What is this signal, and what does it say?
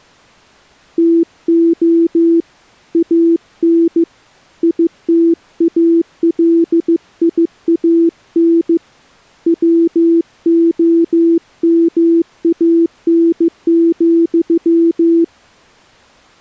Morse code, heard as a keyed tone, hand-sent with a paddle, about 15 wpm, 330 Hz. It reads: TO AN ITALIAN WOMAN,